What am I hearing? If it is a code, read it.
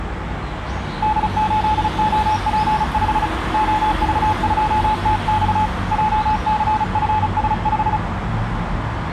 Morse code, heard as a keyed tone, hand-sent with a paddle, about 35 wpm, 860 Hz, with street noise. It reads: D8OP5 OV2TX JCFS5